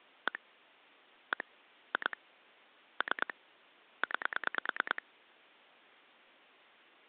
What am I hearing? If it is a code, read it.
Pulse dialling, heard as clicks on a phone line, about 9 pulses a second. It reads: 1 1 2 3 9